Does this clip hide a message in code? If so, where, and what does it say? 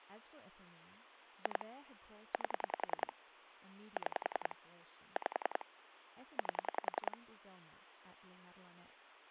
Yes: pulse dialling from 1.5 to 7.1 s, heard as clicks on a phone line, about 10 pulses a second, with speech in English. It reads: 2 8 6 5 8